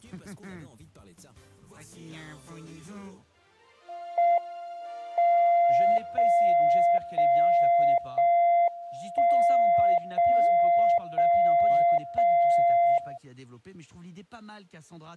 Radio time signal (JJY), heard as a tone whose level steps once a second, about 690 Hz. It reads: M 0 0 0 1 0 0 0 0